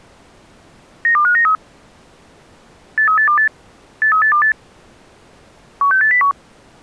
Five-tone selective call (CCIR), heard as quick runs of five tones, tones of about 100 ms. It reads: 92593 83828 83828 16801